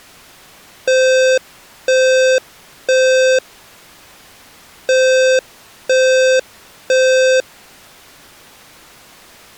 Alarm pattern, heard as an alarm's beeps, played twice, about 520 Hz. Temporal three. Smoke or fire, evacuate.